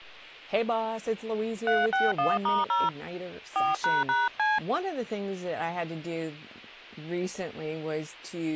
DTMF, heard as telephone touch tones, dialled by hand, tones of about 190 ms, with speech in English. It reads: 361*0 4##C